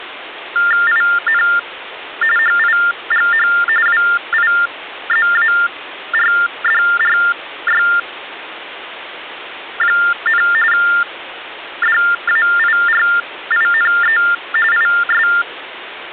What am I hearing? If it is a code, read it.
TTY/TDD text telephone tones (45.45 baud Baudot), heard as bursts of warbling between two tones, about 400 Hz shift, 1600 Hz centre, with phone line noise. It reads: IN HIGH WIZARDRY, DAIRINE IS